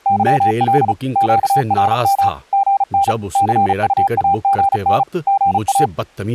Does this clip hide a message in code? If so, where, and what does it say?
Yes: Morse code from 0.0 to 5.9 s, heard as a keyed tone, machine-sent, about 35 wpm, 790 Hz, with speech in Urdu. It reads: YL QRM GN CUAGN GA